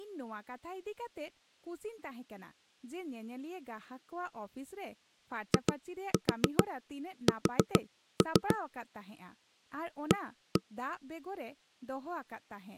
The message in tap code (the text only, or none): IS A